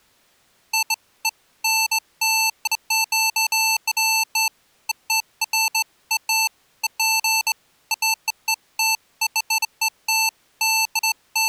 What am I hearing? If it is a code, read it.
Beeps of irregular length. There is no code.